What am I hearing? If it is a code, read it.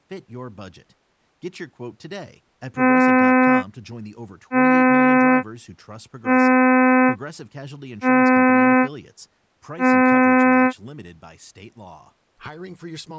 Ship horn signal, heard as a ship's horn, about 260 Hz, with speech in English. 5 short. At sea: I doubt that you are doing enough to avoid a collision.